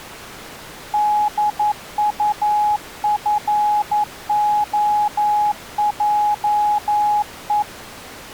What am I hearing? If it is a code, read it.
Morse code, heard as a keyed tone, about 11 wpm, 840 Hz. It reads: DUFOJE